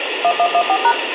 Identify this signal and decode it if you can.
DTMF, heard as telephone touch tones, dialled by machine, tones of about 70 ms, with phone line noise and room echo. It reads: 1114#